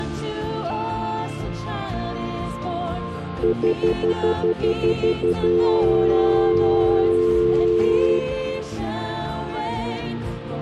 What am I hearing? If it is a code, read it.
Telephone call progress tone (North American plan), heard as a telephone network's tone, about 350, 440 Hz, 0.1 s on and 0.1 s off. Stutter dial tone.